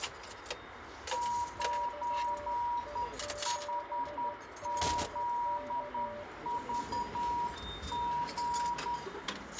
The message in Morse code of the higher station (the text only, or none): 9HZVG